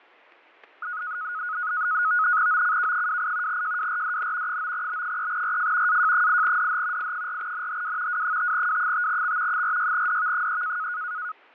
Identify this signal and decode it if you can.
NAVTEX (SITOR-B), 100 baud, 170 Hz shift, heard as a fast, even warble, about 1360 Hz centre, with fading and static crashes. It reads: OCK28 JWRDN 9B3RF AJ8DH I4NHW W5W5X 46DV3